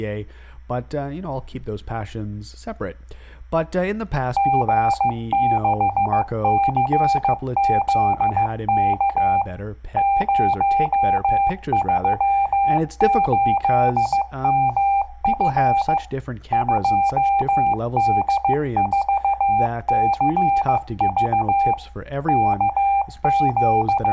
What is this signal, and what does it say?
Morse code, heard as a keyed tone, machine-sent, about 15 wpm, 790 Hz. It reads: G6CZK 038MF 2D4CV …